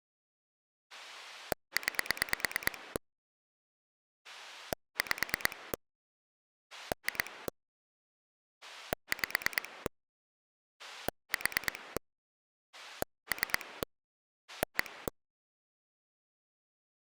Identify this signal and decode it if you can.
Pulse dialling, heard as a rotary dial, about 9 pulses a second. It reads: 9 5 2 5 4 3 1